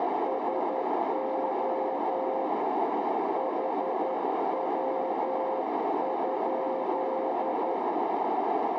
Morse code, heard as a keyed tone, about 11 wpm, 530 Hz, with heavy radio static and a narrow filter. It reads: SO HW?